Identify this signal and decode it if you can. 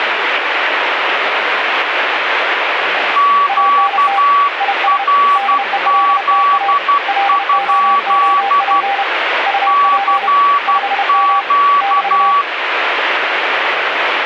Morse code, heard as two keyed tones, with radio static. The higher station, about 12 wpm, 1140 Hz: QRZ? CQ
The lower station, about 31 wpm, 800 Hz: ANT IS DELTA LOOP UP 5M <BT>